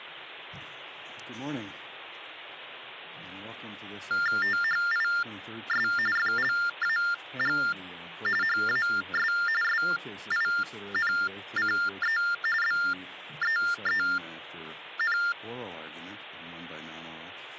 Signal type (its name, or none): TTY/TDD text telephone tones